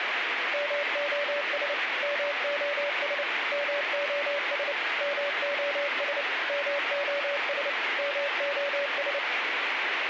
Morse code, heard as a keyed tone, machine-sent, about 29 wpm, 570 Hz, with radio static. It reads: MOS MOS MOS MOS MOS MOS